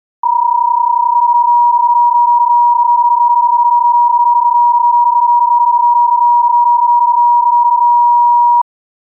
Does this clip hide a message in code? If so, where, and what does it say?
Yes: PSK31 (31.25 baud) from 0.2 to 8.6 s, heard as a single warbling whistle, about 960 Hz.